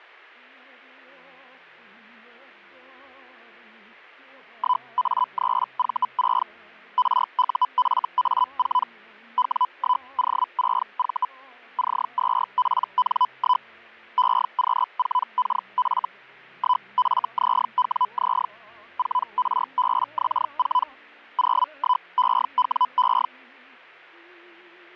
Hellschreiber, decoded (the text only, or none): 1A3V6 RUFA4 W1O6V C2PN1 EQ4KF 1FZWZ 4RBX4 01EWE